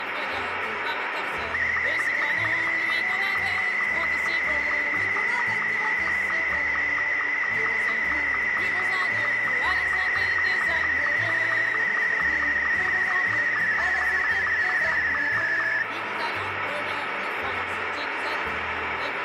SSTV (slow-scan television), Martin M2, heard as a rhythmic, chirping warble, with radio static.